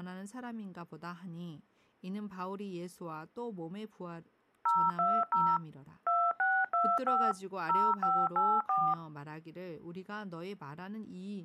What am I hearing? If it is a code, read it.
DTMF, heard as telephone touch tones, dialled by machine, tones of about 250 ms, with speech in Korean. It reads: 020 2625 0584